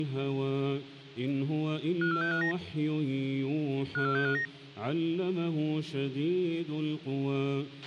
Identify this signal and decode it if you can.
Five-tone selective call (CCIR), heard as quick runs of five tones, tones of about 100 ms, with a squelch burst at the end. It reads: 54659 54659